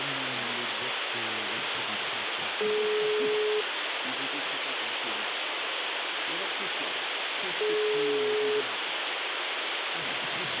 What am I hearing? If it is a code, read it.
Telephone call progress tone (single-tone plan, as in most of Europe), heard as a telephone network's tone, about 420 Hz, 1 s on and 4 s off, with phone line noise. Ringback tone.